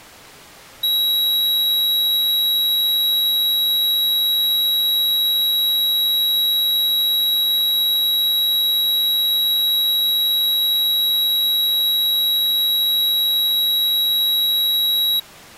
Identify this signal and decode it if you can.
A steady tone. There is no code.